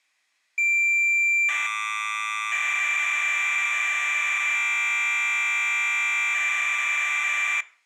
Cassette data (Kansas City type), 1200 baud, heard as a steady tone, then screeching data.